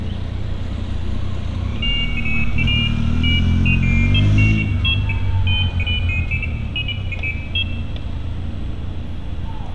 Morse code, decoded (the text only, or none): none